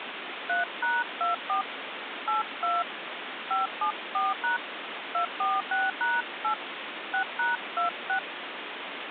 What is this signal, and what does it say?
DTMF, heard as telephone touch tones, dialled by hand, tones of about 160 ms, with phone line noise. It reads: 3#24 82 574# 246#8 6#26